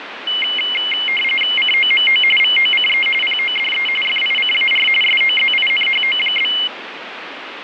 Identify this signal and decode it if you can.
RTTY (45.45 baud, 850 Hz shift), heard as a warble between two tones, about 2550 Hz centre, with radio static. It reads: COMO VOCE PODE FICAR SOZINHO?